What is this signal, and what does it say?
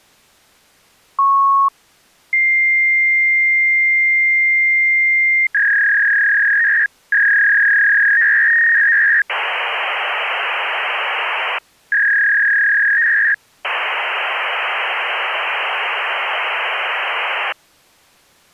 Fax machine handshake, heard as a beep, a long tone, a warble and hiss.